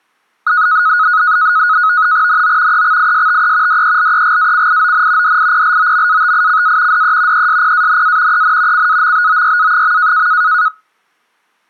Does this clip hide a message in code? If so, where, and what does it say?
Yes: NAVTEX (SITOR-B), 100 baud, 170 Hz shift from 0.5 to 10.7 s, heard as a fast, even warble, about 1360 Hz centre. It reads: NO EXISTE DELEGACION DIPLOMATICA DE ESPANA EN CAMBOYA.